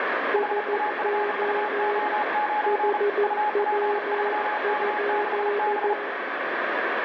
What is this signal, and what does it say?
Morse code, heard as two keyed tones, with radio static and room echo. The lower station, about 14 wpm, 410 Hz: SO HW?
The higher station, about 35 wpm, 840 Hz: HAFUO9 UP3K6B